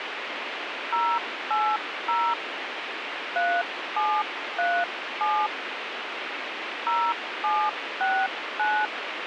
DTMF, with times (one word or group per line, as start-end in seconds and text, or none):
0.9-2.3 080
3.4-5.5 3737
6.9-8.9 0769